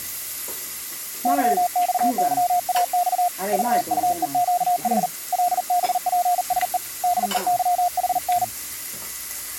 Morse code, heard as a keyed tone, hand-sent with a paddle, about 40 wpm, 710 Hz, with the noise of a restaurant. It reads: YXYAX VUEQH LBPSE DEYHN